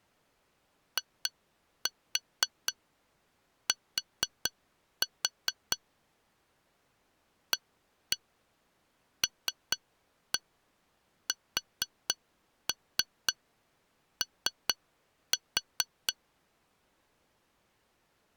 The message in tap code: IT ALSO

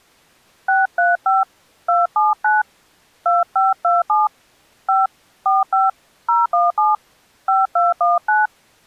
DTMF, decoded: 635 279 2527 5 45 017 5219

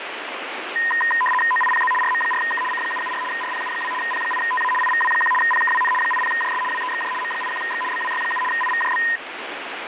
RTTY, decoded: OIPZ RM4K C774 RPU2 P8TA IVW1 PKWN 80JS WEXJ M81X BWY7 IVJB

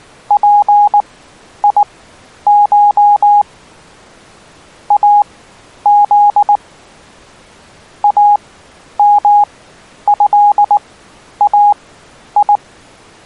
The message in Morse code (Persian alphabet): پیش از امضای

